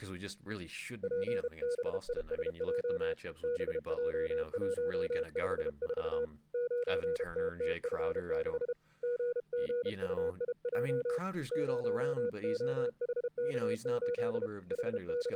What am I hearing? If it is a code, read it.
Morse code, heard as a keyed tone, hand-sent with a paddle, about 32 wpm, 480 Hz, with speech in English. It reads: PBISJ BJ154 9TTF6 GGUIJ 0OHK8 …